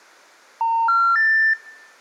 Telephone call progress tone (North American plan), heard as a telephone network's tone, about 910, 1370, 1800 Hz. Special information tone.